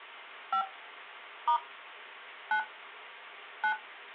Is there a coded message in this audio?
Yes: DTMF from 0.5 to 3.7 s, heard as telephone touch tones, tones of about 90 ms. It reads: 5 * 9 9